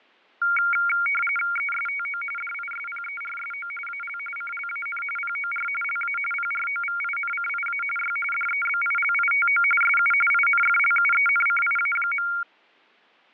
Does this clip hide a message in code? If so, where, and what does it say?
Yes: RTTY (45.45 baud, 850 Hz shift) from 0.4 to 12.4 s, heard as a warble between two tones, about 1800 Hz centre, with fading and static crashes. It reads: ESTO DISPERSO AL CLAN POR LA PROVINCIA Y DEBILITO SU INFLUENCIA.